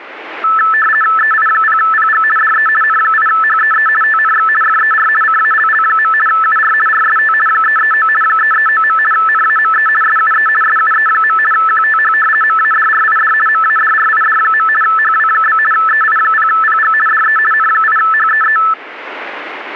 RTTY (50 baud, 450 Hz shift), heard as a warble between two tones, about 1550 Hz centre. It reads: EI0PG DE N8HEE TNX FER CALL. UR RST 339 339. NAME SUE SUE. QTH MADRID MADRID. HW? EI0PG DE N8HEE